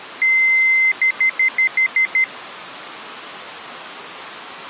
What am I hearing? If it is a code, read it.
Beep code, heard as a piezo beeper, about 2050 Hz. 1 long, 7 short.